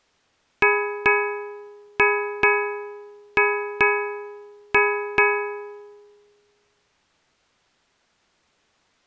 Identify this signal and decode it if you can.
Ship's bell, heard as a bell. 8. Eight half-hours of the watch have passed.